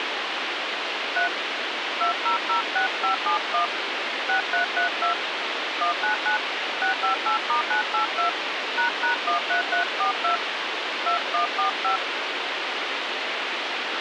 DTMF, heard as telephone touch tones, dialled by hand, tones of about 110 ms, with radio hiss. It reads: 3 2006571 6332 199 658*982 ##13342 2145